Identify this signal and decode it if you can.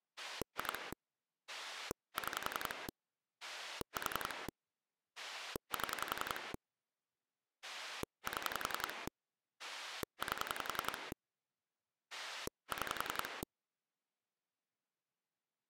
Pulse dialling, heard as a rotary dial, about 11 pulses a second. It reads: 2 6 4 7 7 8 6